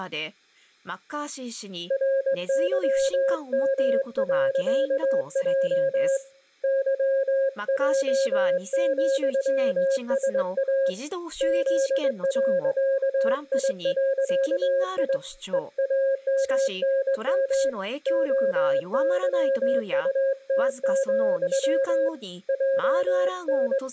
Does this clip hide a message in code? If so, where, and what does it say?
Yes: Morse code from 1.8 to 23.9 s, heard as a keyed tone, hand-sent with a straight key, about 21 wpm, 540 Hz, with room echo and speech in Japanese. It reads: RYM.J YJ,SA Z.I.I EAMNM OYUT, …